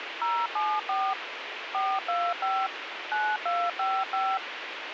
DTMF, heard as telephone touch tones, dialled by machine, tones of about 240 ms, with radio hiss. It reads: 074 425 9255